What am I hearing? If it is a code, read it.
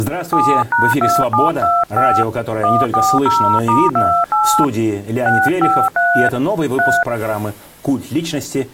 DTMF, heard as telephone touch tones, dialled by hand, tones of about 250 ms. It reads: 7#2725 140*28 653 3